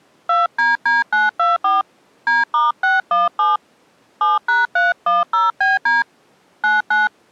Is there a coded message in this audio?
Yes: DTMF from 0.3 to 7.1 s, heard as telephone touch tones, dialled by hand, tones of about 170 ms. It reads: 2DD924 D*617 7#310BD 99